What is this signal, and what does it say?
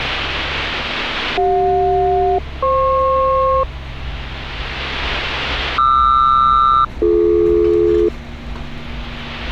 Aircraft SELCAL, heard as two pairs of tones, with street noise. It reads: CJ-FP QR-BD